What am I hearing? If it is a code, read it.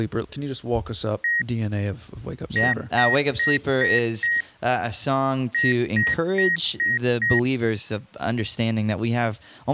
Beep code, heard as beeps from a small speaker, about 1900 Hz, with speech in English. 1-5-5.